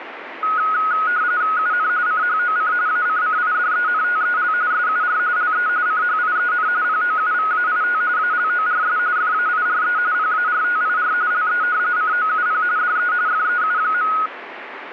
RTTY (45.45 baud, 170 Hz shift), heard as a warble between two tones, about 1360 Hz centre, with radio static. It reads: UN CHOC ACCIDENTEL SUR LE CHIEN POUVAIT ALORS FAIRE PARTIR LE COUP DE FEU.